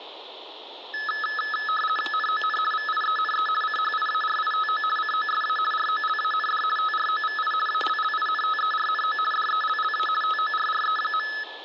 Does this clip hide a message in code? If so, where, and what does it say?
Yes: RTTY (50 baud, 450 Hz shift) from 0.9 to 11.4 s, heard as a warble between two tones, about 1500 Hz centre, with static crashes. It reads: NON VIENE CHIARITO COSA ROLAND TROVI ALLINTERNO DELLA TORRE.